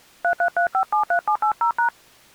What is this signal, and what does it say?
DTMF, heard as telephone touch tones, dialled by hand, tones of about 100 ms. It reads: 333573780#